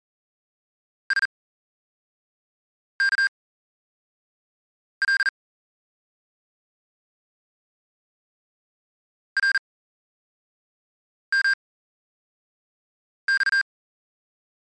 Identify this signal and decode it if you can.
Morse code, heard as electronic beeps, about 40 wpm, spaced as for 5 wpm, 1600 Hz. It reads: SKL RMX